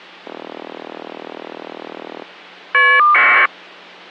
Caller ID data burst, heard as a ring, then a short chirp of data, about 1200 baud.